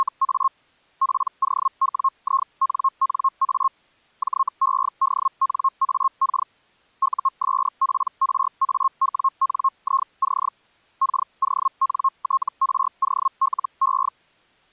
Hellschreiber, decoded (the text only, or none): … POWINNA JEDNAK USPRAWNIC KONTROLE